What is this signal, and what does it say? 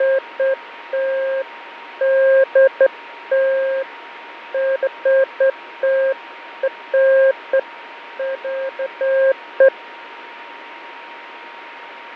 Beeps of irregular length, with radio static, fading and a steady whistle near 940 Hz. There is no code.